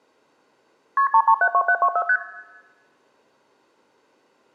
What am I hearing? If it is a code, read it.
Multi-frequency trunk signalling (R1, as on North American trunks), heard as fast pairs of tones, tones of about 70 ms, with room echo. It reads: KP 3372724 ST